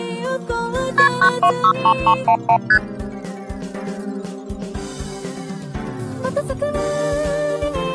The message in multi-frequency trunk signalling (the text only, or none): KP 9263311 ST